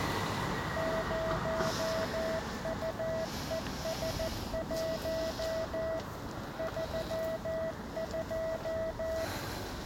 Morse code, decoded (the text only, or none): 0UES1 32